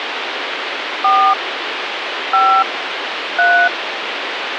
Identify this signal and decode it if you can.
DTMF, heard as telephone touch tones, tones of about 300 ms, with phone line noise. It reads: 4 5 3